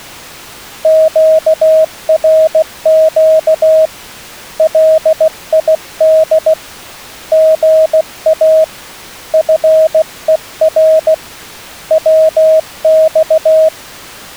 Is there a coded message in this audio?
Yes: Morse code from 0.8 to 13.7 s, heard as a keyed tone, hand-sent with a paddle, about 16 wpm, 630 Hz. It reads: QRQ LID GA FER WX